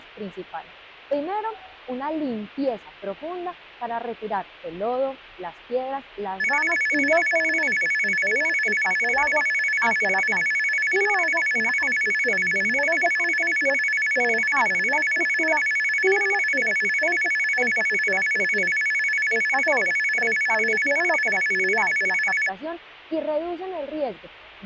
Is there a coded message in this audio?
No, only a tone that alternates evenly between two pitches.